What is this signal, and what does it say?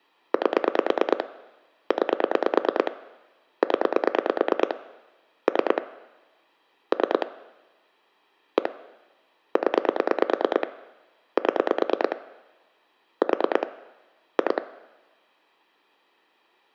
Pulse dialling, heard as clicks on a phone line, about 9 pulses a second. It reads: 8 9 0 3 3 1 0 7 4 2